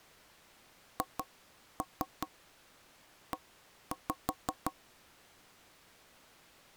Tap code, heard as knocks on wood, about 5 knocks a second. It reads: HE